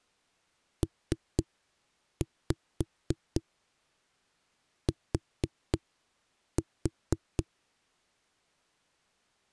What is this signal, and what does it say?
Tap code, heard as knocks on a wall, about 4 knocks a second. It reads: PT